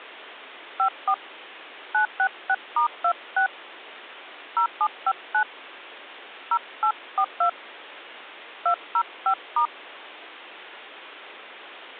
DTMF, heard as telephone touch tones, dialled by hand, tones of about 80 ms. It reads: 54 966*26 0759 0842 205*